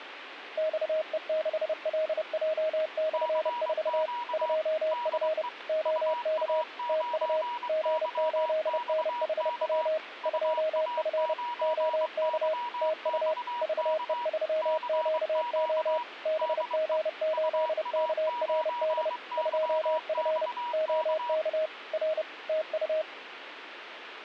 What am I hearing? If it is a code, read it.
Morse code, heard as two keyed tones, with radio static. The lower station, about 30 wpm, 630 Hz: XE6LJ/4 2F OK TU G8NHW 2F OK TU VE3QO BG8KRD 2F OK R TU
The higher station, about 23 wpm, 960 Hz: CQ DE UA9YXK UA9YXK CQ DE UA9YXK